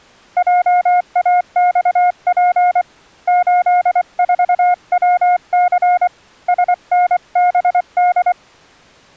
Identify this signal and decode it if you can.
Morse code, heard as a keyed tone, hand-sent with a paddle, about 24 wpm, 720 Hz. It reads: JAXP 84WC SNBD